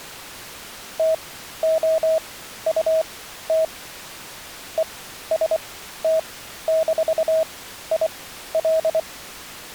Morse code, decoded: TOUT EST-IL

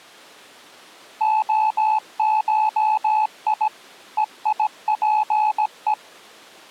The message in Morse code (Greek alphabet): ΟΧΙ ΕΙΠΕ

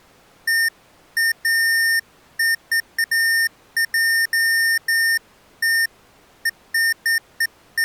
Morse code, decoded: none

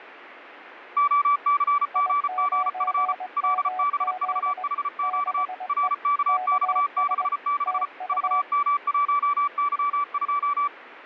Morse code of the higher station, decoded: OCGGF LBVHQ RKX66 VM1Y2

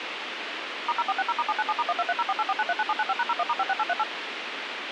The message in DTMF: *0460*797*1230484939795#01*56838

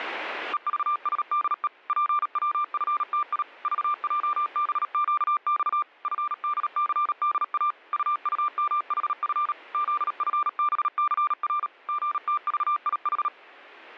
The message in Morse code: EVSDE PWFTI VJBQX FDCDA UUMHF ZFBCR GTVIH

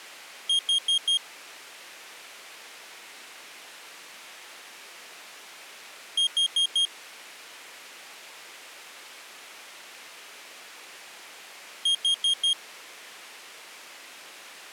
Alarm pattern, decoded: temporal four

